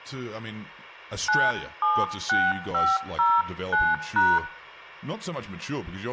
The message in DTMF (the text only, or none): 976509#